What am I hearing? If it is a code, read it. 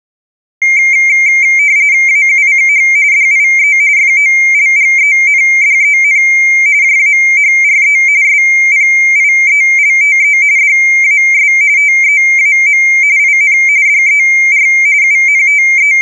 RTTY (45.45 baud, 170 Hz shift), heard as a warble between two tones, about 2200 Hz centre. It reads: AUCH DIE FOLGENDEN JAHRE SPIELTE DAS TEAM IN DER …